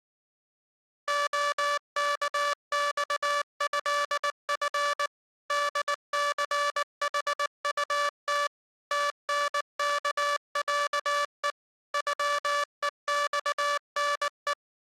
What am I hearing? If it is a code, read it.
Morse code (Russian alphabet), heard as a buzzer, machine-sent, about 19 wpm. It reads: ОКЬЭФ ДЦХУТ ТНКЯЕ ЮЕЬНЕ